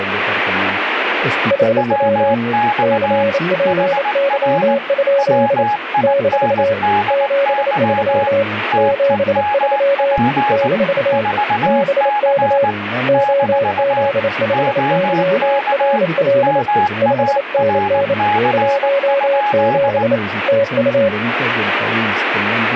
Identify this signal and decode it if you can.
Morse code, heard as two keyed tones, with radio static. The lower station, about 28 wpm, 560 Hz: HW CPY? - 73 73 - BK OZ5YRL 5NN 17 TU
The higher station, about 19 wpm, 830 Hz: WX HR WINDY TEMP 4C - OK MARC?